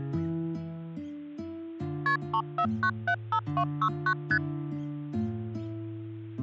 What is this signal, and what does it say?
Multi-frequency trunk signalling (R1, as on North American trunks), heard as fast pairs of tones, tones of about 70 ms, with hum. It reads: KP 34975269 ST